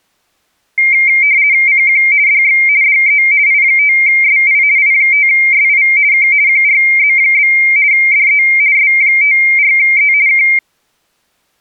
RTTY (50 baud, 170 Hz shift), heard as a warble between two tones, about 2200 Hz centre. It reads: CQ DX DE I5SI I5SI K QRZ? DE S54E K